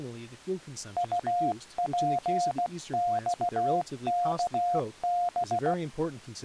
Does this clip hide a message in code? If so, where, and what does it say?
Yes: Morse code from 0.9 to 5.8 s, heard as a keyed tone, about 16 wpm, 710 Hz, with speech in English. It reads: UPXKB